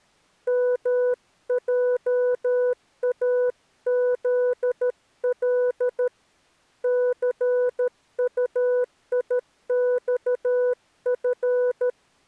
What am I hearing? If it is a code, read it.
Morse code, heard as a keyed tone, hand-sent with a paddle, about 13 wpm, 500 Hz. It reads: MJAZL CUIXF